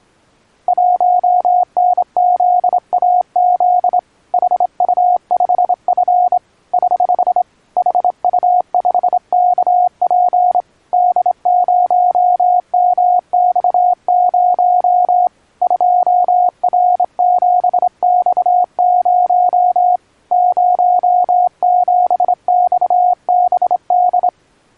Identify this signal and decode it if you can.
Morse code, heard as a keyed tone, hand-sent with a straight key, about 26 wpm, 720 Hz. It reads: 1NZAZ HU5F <HH> HU5KP D0MX0 2R7X0 07XBD